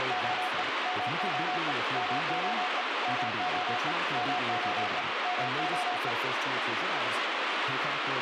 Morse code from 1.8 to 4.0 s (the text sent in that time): MOE MOE